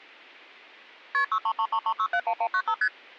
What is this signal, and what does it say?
Multi-frequency trunk signalling (R1, as on North American trunks), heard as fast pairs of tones, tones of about 70 ms. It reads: KP 63333671195 ST